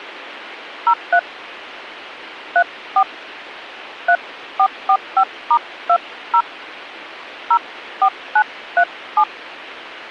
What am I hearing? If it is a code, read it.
DTMF, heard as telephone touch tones, dialled by hand, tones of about 70 ms. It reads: 03 34 3445*20 04937